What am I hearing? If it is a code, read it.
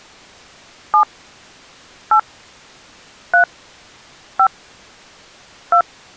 DTMF, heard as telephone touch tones, dialled by hand, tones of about 80 ms. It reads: 7 8 3 5 2